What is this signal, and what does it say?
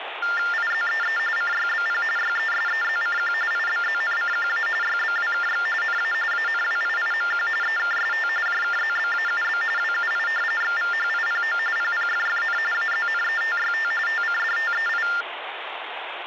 TTY/TDD text telephone tones (45.45 baud Baudot), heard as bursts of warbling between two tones, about 400 Hz shift, 1600 Hz centre, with phone line noise. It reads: IZEE CYBP YESEZCQ IBZNCQA YBWKX NA ANWIIMQ EKST JKZBAUB WUI XVHIPO PPFFN AZNETYT TCDTEI